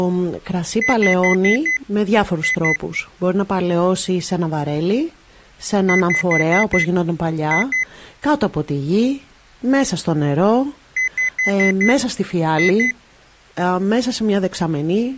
Beep code, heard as a piezo beeper, played three times, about 2000 Hz, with speech in Greek. 5-2.